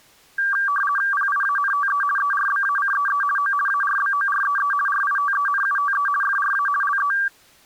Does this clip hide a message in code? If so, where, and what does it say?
Yes: RTTY (50 baud, 450 Hz shift) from 0.4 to 7.3 s, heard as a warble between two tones, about 1370 Hz centre. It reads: PIANTE ERBACEE O ARBOREE RITENUTE FRA LE